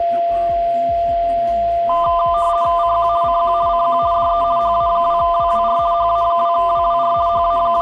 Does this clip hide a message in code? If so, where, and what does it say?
Yes: RTTY (50 baud, 170 Hz shift) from 1.9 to 7.8 s, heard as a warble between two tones, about 1110 Hz centre, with a steady whistle near 690 Hz and room echo. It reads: CQ CQ CQ DE HA2WWR HA2WWR …